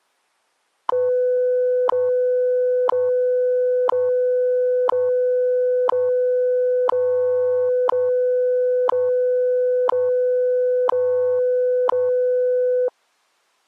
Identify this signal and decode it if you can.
Radio time signal (WWV, Colorado), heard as ticks, one a second.